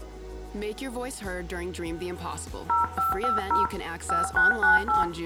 DTMF, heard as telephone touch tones, dialled by hand, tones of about 150 ms, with room echo. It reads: 0550 5698